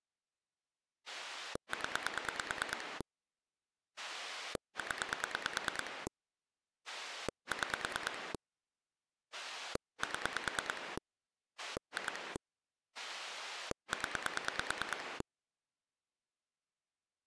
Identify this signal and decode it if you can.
Pulse dialling, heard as a rotary dial, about 9 pulses a second. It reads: 0 0 6 7 2 0